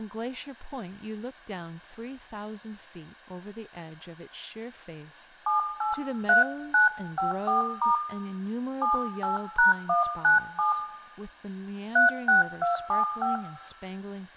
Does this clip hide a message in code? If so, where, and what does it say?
Yes: DTMF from 5.5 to 13.4 s, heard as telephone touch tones, dialled by hand, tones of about 140 ms, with room echo and speech in English. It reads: 783954* 78#197 36275